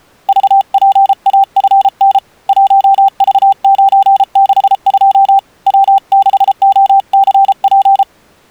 Morse code, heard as a keyed tone, hand-sent with a paddle, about 33 wpm, 780 Hz. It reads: VPAFN 1V962 W6OCP